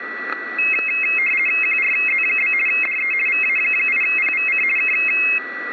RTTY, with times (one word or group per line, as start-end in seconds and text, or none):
1.6-2.5 QRZ?
2.7-3.1 DE
3.3-4.6 VA8PVC
4.8-4.9 K